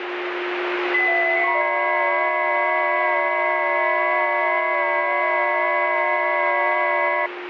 FT8 (several signals at once), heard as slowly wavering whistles, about 6.25 baud, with radio static and a steady whistle near 360 Hz.